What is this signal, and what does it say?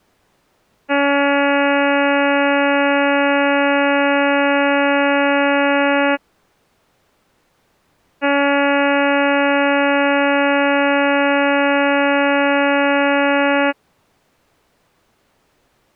Ship horn signal, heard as a ship's horn, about 280 Hz. 2 long. At sea: a vessel under power that has stopped in fog.